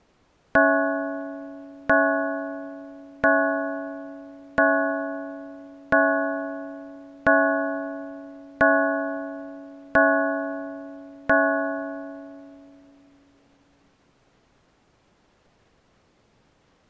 Clock strike, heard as a bell. 9. Nine o'clock.